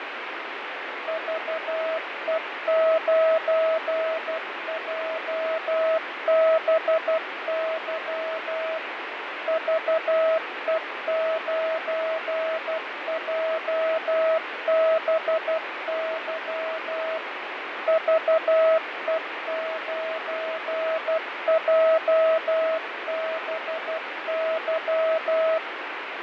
Morse code, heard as a keyed tone, machine-sent, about 12 wpm, 640 Hz, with radio static and fading. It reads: VE9JBY VE9JBY VE9JBY